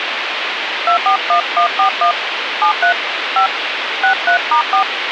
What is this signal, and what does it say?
DTMF, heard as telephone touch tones, dialled by hand, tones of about 100 ms, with phone line noise. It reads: 241141 73 5 63*4